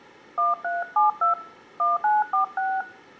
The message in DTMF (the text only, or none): 1372 1946